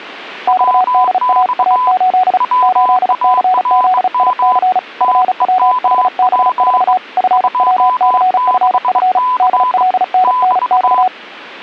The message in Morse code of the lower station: XDAA8 8CZIC FWHB4 FWCFF DLNNX

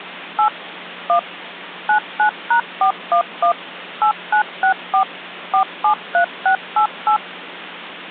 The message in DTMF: 8 1 99#411 8964 473688

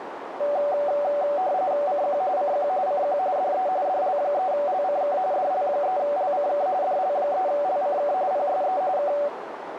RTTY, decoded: CQ CQ CQ DE DL3LCK DL3LCK DL3LCK PSE K

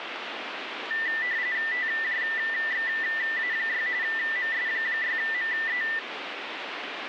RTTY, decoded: TJXA6 MS6ME

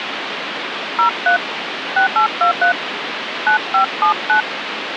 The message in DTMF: 03 6823 9579

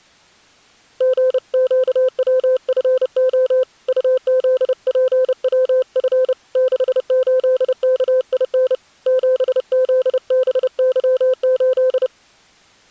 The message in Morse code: GQWFO UZPWF 68KIN 7ZBY8

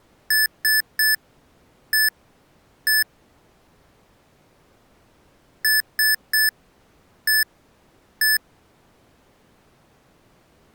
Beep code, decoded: 3-1-1

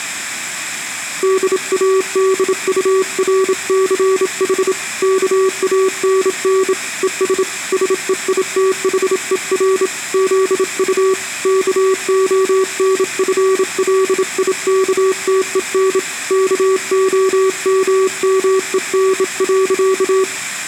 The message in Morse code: DADURCH KANN ES SEITHER ZU KONFLIKTEN KOMMEN.

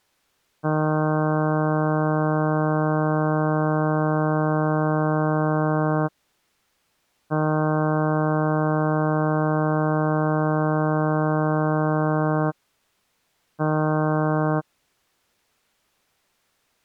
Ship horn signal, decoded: 2 long, 1 short

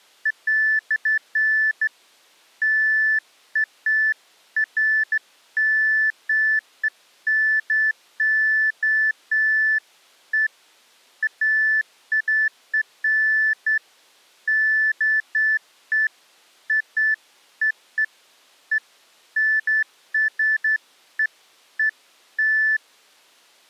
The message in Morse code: none

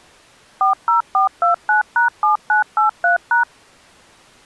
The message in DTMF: 40429#7983#

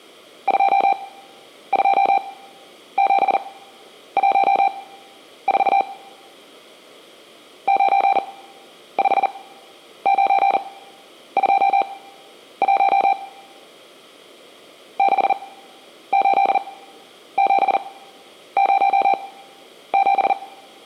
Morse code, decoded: 22714 95921 68707

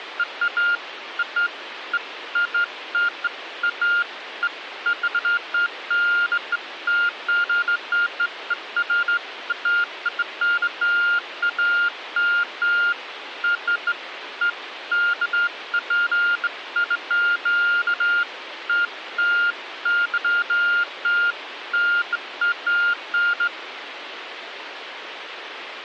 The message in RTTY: none

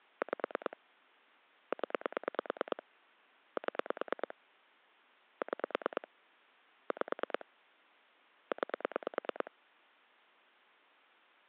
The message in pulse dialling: 5 0 7 6 5 9

